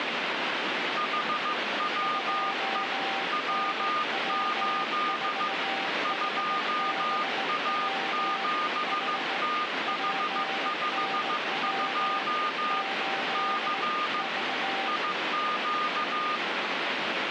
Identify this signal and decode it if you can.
Morse code, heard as two keyed tones, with radio static. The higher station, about 15 wpm, 1220 Hz: HWE W8 2A7TH52 C IQ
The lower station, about 18 wpm, 780 Hz: 2NW4HBW H PNW 8 V